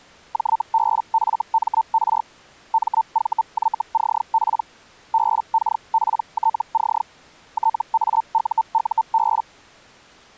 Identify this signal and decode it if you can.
Hellschreiber (Feld-Hell, 122.5 baud), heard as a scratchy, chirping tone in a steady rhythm, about 900 Hz. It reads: JBFMR MVYCP BKPTC TAUUB